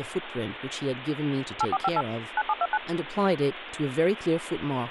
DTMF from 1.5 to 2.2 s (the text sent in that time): 8458